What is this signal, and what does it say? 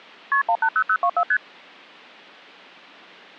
Multi-frequency trunk signalling (R1, as on North American trunks), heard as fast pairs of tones, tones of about 70 ms. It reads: KP 180024 ST